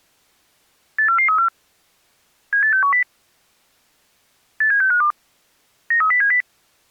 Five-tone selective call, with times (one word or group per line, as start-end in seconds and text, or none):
1.0-1.5 84434
2.5-3.0 78610
4.6-5.1 87652
5.9-6.4 93070